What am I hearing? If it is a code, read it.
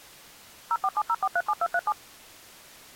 DTMF, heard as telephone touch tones, dialled by machine, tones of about 50 ms. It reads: 0470437237